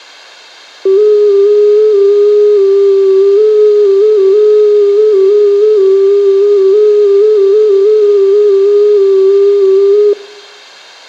FT8 (one signal), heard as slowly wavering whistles, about 6.25 baud, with room echo.